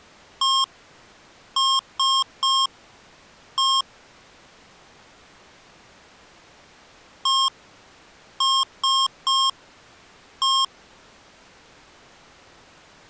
Beep code, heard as beeps from a small speaker, played twice, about 1070 Hz. 1-3-1. In Phoenix BIOS tables: memory refresh failure.